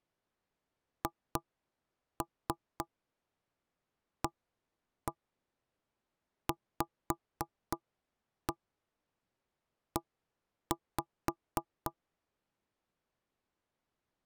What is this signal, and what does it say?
Tap code, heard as knocks on wood, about 3 knocks a second. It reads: HAVE